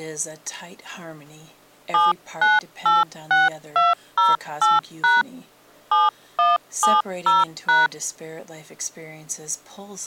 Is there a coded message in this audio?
Yes: DTMF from 1.9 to 7.9 s, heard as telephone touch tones, dialled by hand, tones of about 180 ms. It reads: 7986208# 7170#